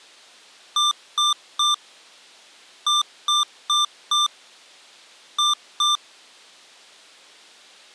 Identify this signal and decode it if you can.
Beep code, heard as beeps from a small speaker, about 1190 Hz. 3-4-2.